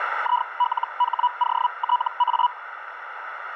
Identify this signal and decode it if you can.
Hellschreiber (Feld-Hell, 122.5 baud), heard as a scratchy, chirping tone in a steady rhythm, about 980 Hz, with radio static and a narrow filter. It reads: ILHOTA